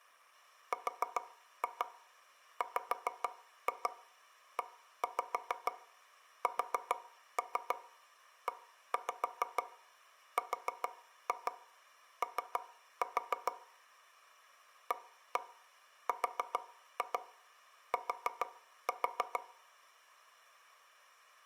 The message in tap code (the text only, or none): RWESERO ART